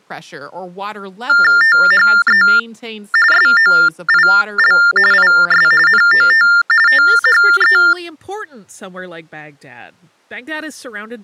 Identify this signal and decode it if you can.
TTY/TDD text telephone tones (45.45 baud Baudot), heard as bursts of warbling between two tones, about 400 Hz shift, 1600 Hz centre, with speech in English. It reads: THE SOIL IS NOT THE